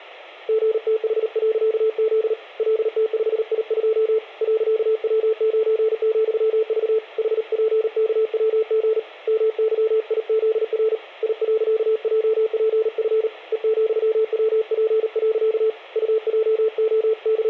Morse code, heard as a keyed tone, hand-sent with a paddle, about 38 wpm, 440 Hz, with room echo. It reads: GTH.Z LT5I2 .W9,V HPKWG MYIZR I.JPF E,WP. …